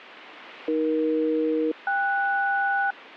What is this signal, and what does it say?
Aircraft SELCAL, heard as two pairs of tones, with radio static. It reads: AE-KS